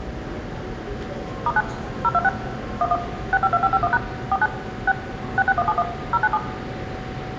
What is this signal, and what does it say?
DTMF, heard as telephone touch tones, dialled by machine, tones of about 40 ms, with room echo and the noise of a subway station. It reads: *9 026 11 652551# 49 6 66171 097